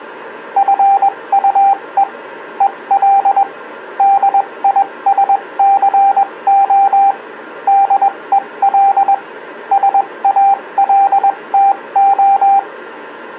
Morse code, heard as a keyed tone, machine-sent, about 21 wpm, spaced as for 18 wpm, 790 Hz. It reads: FUE EL DISCO DEL SALTO